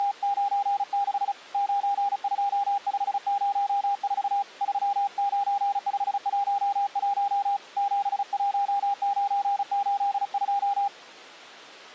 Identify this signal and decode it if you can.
Morse code, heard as a keyed tone, hand-sent with a paddle, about 35 wpm, 800 Hz. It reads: … 92504 39511 71982